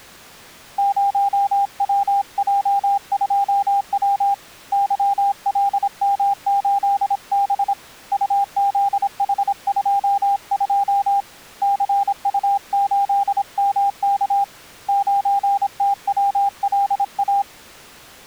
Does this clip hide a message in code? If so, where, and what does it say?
Yes: Morse code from 0.7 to 17.5 s, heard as a keyed tone, hand-sent with a paddle, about 26 wpm, 800 Hz. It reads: 0WJ2W YLM8B UZH22 CU8MK 9TWLA